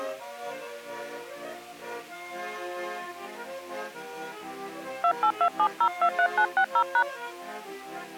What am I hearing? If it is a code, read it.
DTMF, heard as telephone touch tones, dialled by hand, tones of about 80 ms. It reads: 2827023960#